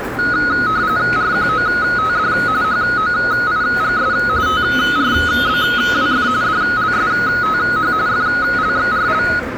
RTTY (45.45 baud, 170 Hz shift), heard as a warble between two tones, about 1360 Hz centre, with radio static, a narrow filter and the noise of a subway station. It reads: RQOTD HOIGS TRBWF DLSTH FLXRL